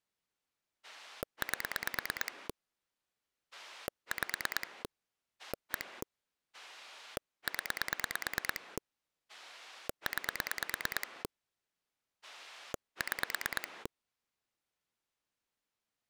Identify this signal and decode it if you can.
Pulse dialling, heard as a rotary dial, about 9 pulses a second. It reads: 8 5 1 0 9 6